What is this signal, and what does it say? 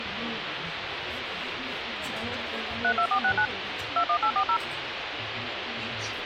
DTMF, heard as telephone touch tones, dialled by machine, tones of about 80 ms, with phone line noise and the noise inside a lift. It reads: 32469 21840